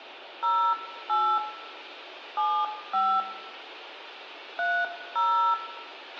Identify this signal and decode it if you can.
DTMF, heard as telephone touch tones, dialled by hand, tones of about 290 ms, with radio hiss, a squelch burst at the end and room echo. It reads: 08 75 30